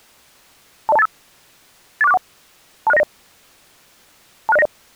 Five-tone selective call (EIA), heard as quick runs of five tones, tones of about 30 ms. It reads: 20285 84641 26090 26090